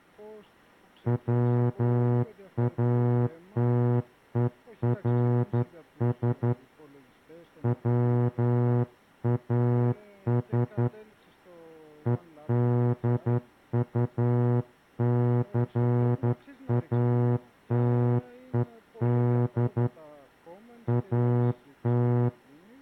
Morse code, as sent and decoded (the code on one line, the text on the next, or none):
.-- .- - . .-. ... / .-- .- ... / . -.. ..- -.-. .- - . -.. / .- -
WATERS WAS EDUCATED AT